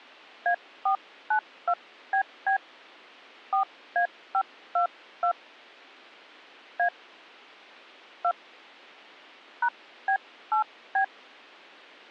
DTMF, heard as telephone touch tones, dialled by hand, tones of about 90 ms. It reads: A492BB 4A522 A 2 #B8B